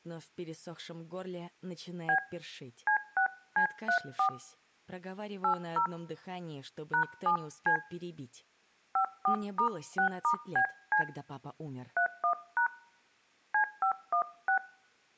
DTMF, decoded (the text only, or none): B C6C34 80 #7C 54*6*BC 31# C516